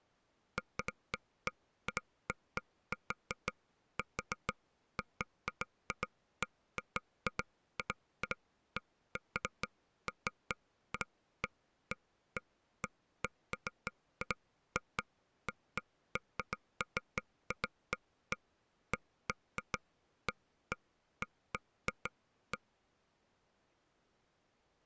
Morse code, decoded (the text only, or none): none